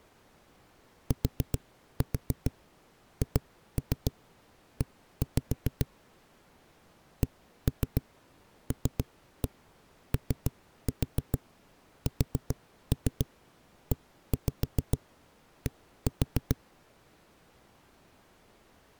Tap code, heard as knocks on a wall, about 7 knocks a second. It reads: THE CLOSED